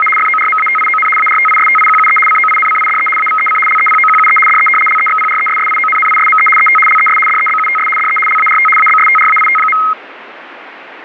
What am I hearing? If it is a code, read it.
RTTY (75 baud, 850 Hz shift), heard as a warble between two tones, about 1700 Hz centre, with radio static. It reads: … FORMATION ARTISTIQUE COINCIDE AVEC LEPOQUE DE LEXPRESSIONNISME ET LES DEBUTS DE LART ABSTRAIT.